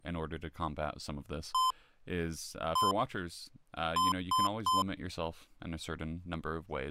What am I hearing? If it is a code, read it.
Beep code, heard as beeps from a small speaker, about 1030 Hz, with speech in English. 1-1-3. In Phoenix BIOS tables: CMOS read or write failure.